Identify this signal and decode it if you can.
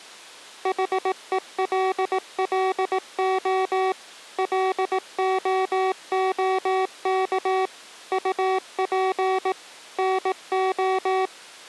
Morse code, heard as electronic beeps, machine-sent, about 18 wpm, 380 Hz. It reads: HELLO LOOK UP NO